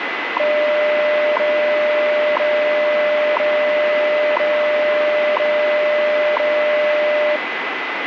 Radio time signal (WWV, Colorado), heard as ticks, one a second, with radio static and a steady whistle near 2010 Hz.